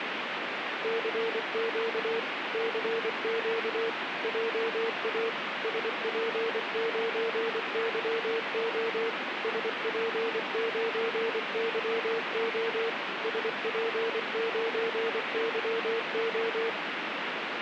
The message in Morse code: CQ CQ JA SP9YO SP9YO SP9YO

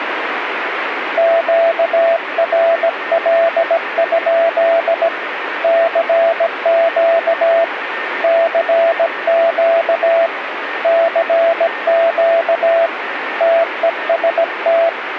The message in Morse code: QRL? CQ CQ CQ TEST

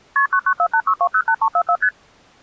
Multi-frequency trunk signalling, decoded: KP 99486208344 ST

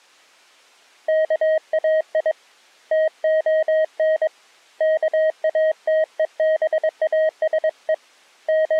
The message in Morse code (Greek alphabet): ΚΑΙ ΤΟΝ ΚΑΤΕΒΑΣΕ …

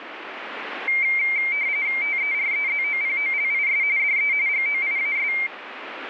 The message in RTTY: TEREZOPOLIS DE GOIAS

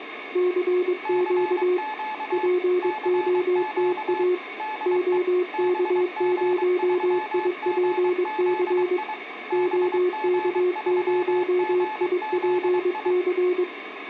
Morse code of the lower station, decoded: CQ POTA OK0IPC OK0IPC

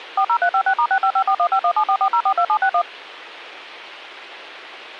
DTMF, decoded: 40356*6554151744042761

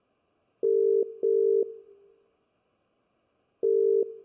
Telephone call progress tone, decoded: ringback tone

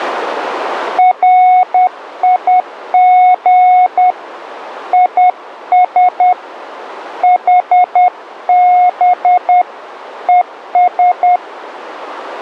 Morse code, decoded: RIG IS HB ES

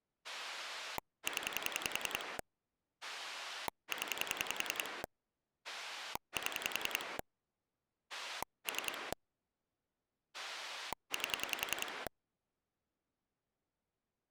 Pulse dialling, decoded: 0 0 7 3 8

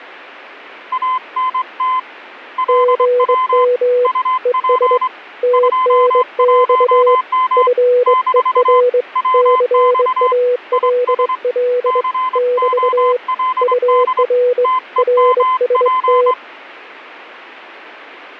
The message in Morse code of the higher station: ANT LW UP 21M - WX IS COLD TEMP

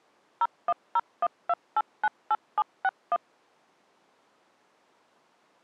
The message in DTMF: 01012898761

